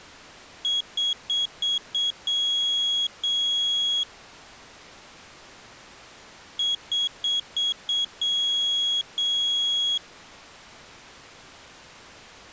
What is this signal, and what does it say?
Beep code, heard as a piezo beeper, played twice, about 3300 Hz. 5 short, 2 long.